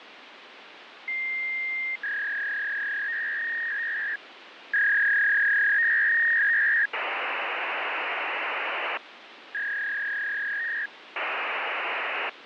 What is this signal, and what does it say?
Fax machine handshake, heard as a long tone, a warble and hiss, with phone line noise.